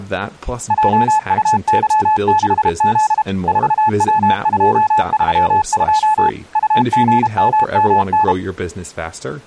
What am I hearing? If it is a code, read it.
Morse code, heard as a keyed tone, machine-sent, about 32 wpm, 860 Hz, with speech in English. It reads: JUY6Z 4W232 UGMMN